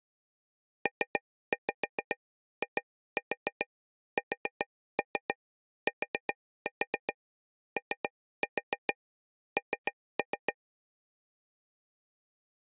Tap code, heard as taps on a table, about 7 knocks a second. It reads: PISTON